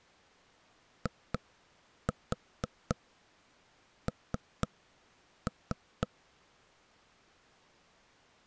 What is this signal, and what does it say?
Tap code, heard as knocks on wood, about 4 knocks a second. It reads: IN